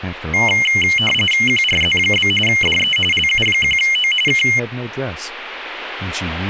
RTTY (45.45 baud, 850 Hz shift), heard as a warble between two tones, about 2550 Hz centre, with speech in English. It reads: QRZ? DE LU1O K